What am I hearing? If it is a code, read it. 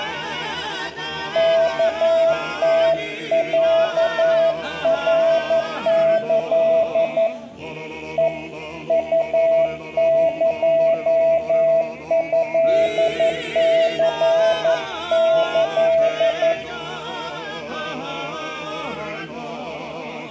Morse code (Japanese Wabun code), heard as a keyed tone, hand-sent with a paddle, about 11 wpm, 660 Hz, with room echo. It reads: ワムロナキ ヘ ウエトニキ